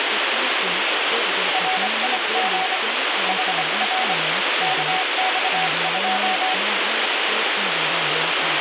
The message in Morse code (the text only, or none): RIG HR KX2